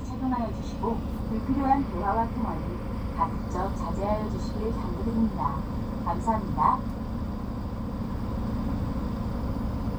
The noise inside a bus. There is no code.